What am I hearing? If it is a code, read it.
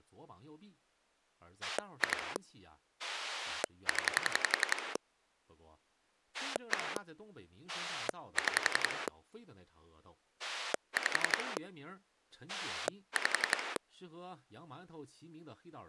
Pulse dialling, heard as a rotary dial, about 11 pulses a second, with speech in Chinese. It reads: 2 0 1 6 5 5